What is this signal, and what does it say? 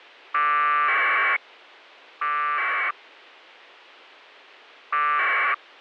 Packet radio (AX.25, as in APRS), 1200 baud, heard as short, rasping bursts.